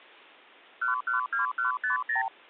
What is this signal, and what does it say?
Multi-frequency trunk signalling (R2, with the far end's replies), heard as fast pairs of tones, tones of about 130 ms. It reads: 112150